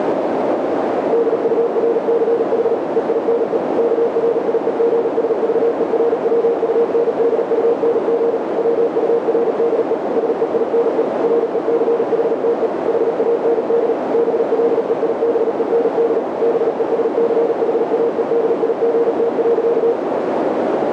Morse code, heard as a keyed tone, machine-sent, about 38 wpm, 470 Hz, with heavy radio static and a narrow filter. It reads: DURCH EINE KRIEGSVERWUNDUNG WURDE SEINE RECHTE HAND BLEIBEND BESCHAEDIGT.